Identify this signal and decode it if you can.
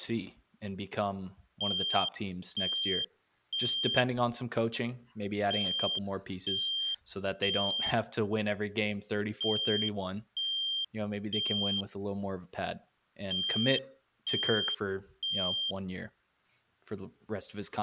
Alarm pattern, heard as an alarm's beeps, played four times, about 3200 Hz, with speech in English. Temporal three. Smoke or fire, evacuate.